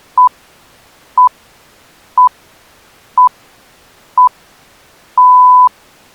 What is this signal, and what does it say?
Radio time signal (six pips, as the Greenwich Time Signal), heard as pips.